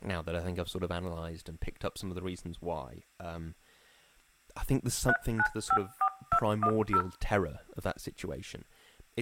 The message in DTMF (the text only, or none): 3954210